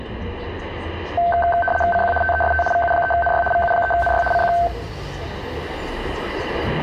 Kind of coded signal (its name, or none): RTTY